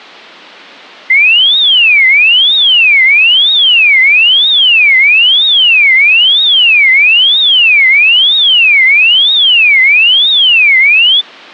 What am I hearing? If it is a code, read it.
A tone that sweeps in pitch again and again. There is no code.